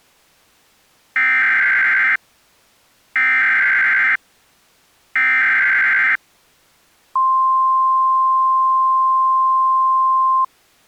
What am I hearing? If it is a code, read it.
Emergency Alert System (SAME) tones (header bursts, then the 1050 Hz attention tone), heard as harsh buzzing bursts, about 520.83 baud.